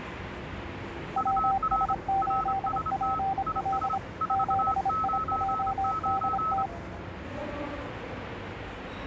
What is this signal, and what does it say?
Morse code, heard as two keyed tones, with the noise of a subway station. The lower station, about 26 wpm, 780 Hz: WS8PL 7IJDT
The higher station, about 27 wpm, 1290 Hz: UR RST IS 499